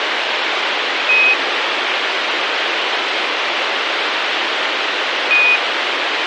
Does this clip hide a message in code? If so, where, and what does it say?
Yes: Quindar tones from 1.1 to 5.6 s, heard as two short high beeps, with radio hiss.